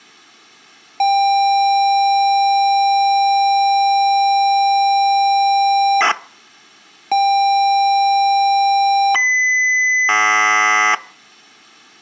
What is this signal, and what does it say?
ZX Spectrum tape loading, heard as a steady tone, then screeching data.